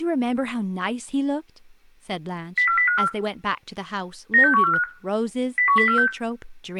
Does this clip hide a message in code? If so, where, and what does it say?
Yes: five-tone selective call (CCIR) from 2.6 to 6.1 s, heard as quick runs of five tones, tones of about 100 ms, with room echo and speech in English. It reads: 04054 96145 01046